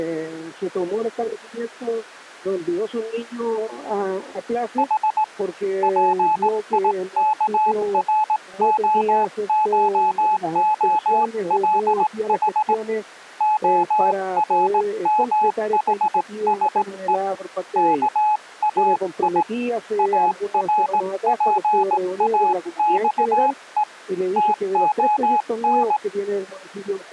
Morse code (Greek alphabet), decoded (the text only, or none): Η ΠΙΚΡΟΧΟΛΗ ΟΡΜΗΣΕ ΚΑΙ ΑΡΠΑΞΕ ΤΟΝ